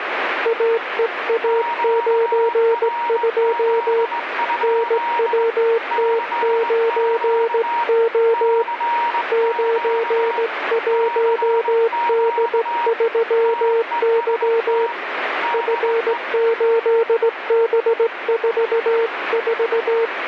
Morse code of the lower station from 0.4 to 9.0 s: AEA92 NWT9O

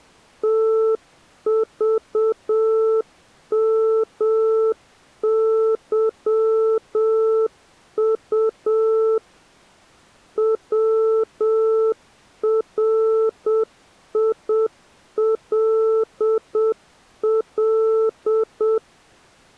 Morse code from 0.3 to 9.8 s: TVMYU

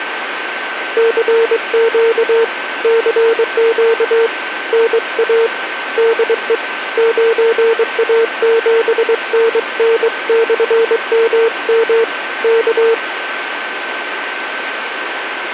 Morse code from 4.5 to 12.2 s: NA DE 9A7NN/MM

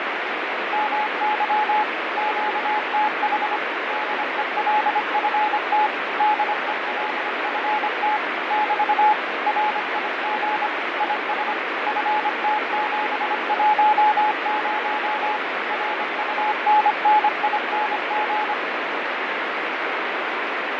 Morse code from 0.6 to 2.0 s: MY

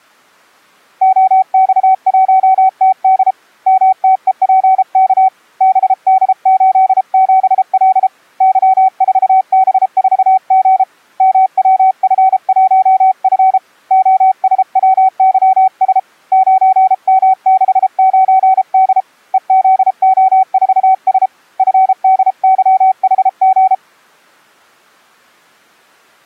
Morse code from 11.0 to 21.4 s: MWF1F OSWYS 9M69D EZO4S

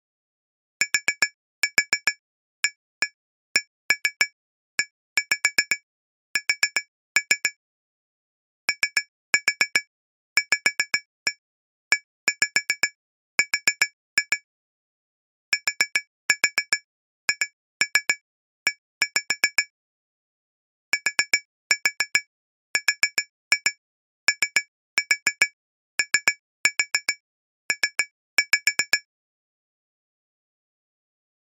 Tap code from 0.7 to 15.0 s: TAKES OVER

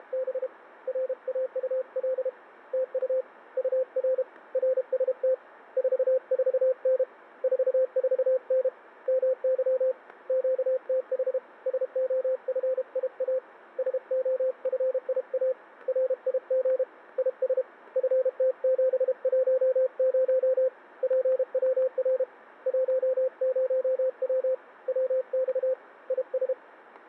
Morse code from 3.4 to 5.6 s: UR RST

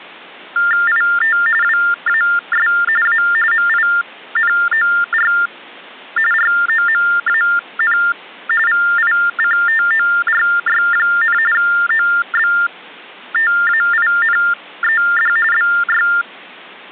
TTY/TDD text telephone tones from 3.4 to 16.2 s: MINOR ROMAN VICTORY, OBTAINED BY

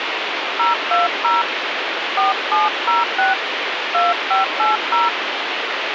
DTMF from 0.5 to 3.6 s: 020 4706

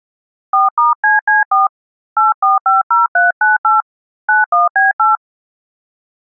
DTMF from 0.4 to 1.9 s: 4*CC4

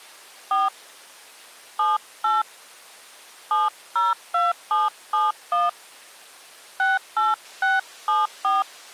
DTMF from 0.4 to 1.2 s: 4

